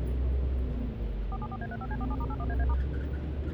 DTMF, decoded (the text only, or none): 474A35C47*81AA*